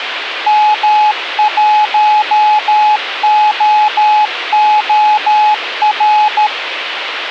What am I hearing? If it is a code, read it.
Morse code, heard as a keyed tone, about 13 wpm, 850 Hz, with radio hiss and a squelch burst at the end. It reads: M1OOR